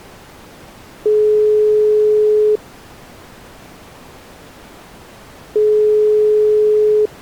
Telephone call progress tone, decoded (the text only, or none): ringback tone